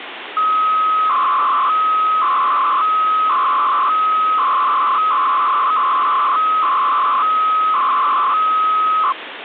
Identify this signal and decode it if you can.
300-baud modem data (Bell 103 tones), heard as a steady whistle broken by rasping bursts, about 300 baud, 200 Hz shift, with phone line noise.